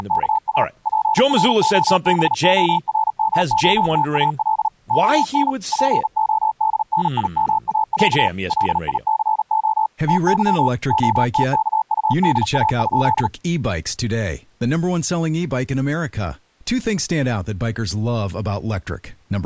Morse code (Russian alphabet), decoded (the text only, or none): … ПРОБОРМОТАЛ ОН ПОДНИМАЯ ЛИЦО ТЫ ОТКУДА?